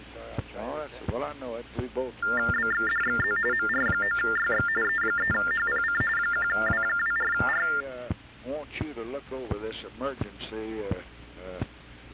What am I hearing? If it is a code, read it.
TTY/TDD text telephone tones (45.45 baud Baudot), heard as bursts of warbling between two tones, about 400 Hz shift, 1600 Hz centre. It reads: BXDXZ MR9YX E3HPC 1W24R